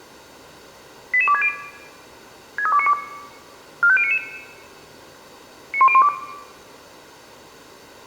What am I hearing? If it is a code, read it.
Five-tone selective call (ZVEI), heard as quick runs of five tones, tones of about 70 ms, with room echo. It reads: 88260 63292 45099 91012